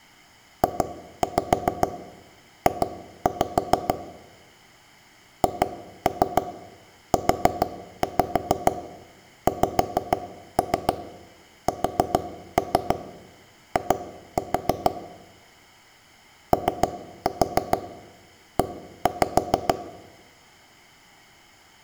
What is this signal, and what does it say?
Tap code, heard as knocks on wood, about 6 knocks a second, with room echo. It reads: JJ HUXSI OE